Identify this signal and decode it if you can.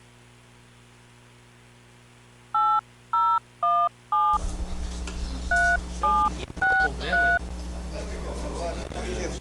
DTMF, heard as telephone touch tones, dialled by hand, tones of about 250 ms. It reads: 8017 3763